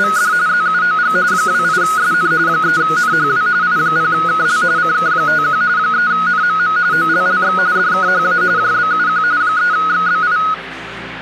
RTTY (45.45 baud, 170 Hz shift), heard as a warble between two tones, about 1360 Hz centre, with radio static. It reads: … ZUOG 28SN 3NHW I0KL CK51 3NMM OLLX DKHA JBUQ 3XBI